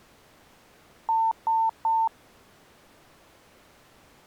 Beep code, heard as beeps, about 900 Hz. 3 short. In AMI BIOS tables: failure in the first 64 KB of memory; in Dell tables: chipset error.